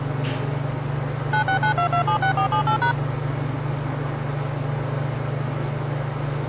DTMF, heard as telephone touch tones, dialled by machine, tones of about 100 ms, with the noise inside a lift. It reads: 9692276478#